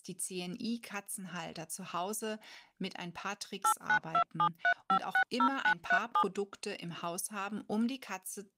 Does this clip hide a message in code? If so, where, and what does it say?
Yes: DTMF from 3.6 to 6.2 s, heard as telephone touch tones, dialled by machine, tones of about 80 ms, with speech in German. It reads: 89273560937